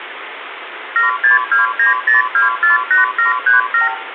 Multi-frequency trunk signalling (R2, with the far end's replies), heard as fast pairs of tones, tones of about 140 ms, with phone line noise and room echo. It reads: 76290248737